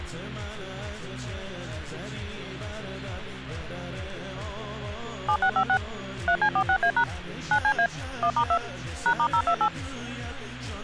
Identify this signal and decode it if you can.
DTMF, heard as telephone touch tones, dialled by machine, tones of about 80 ms. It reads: 7656 3C46A# 9CA 1*2 #*028